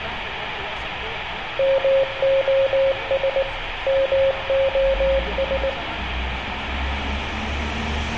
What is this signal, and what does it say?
Morse code, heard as a keyed tone, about 19 wpm, 540 Hz, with radio static, room echo and street noise. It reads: MOS MOS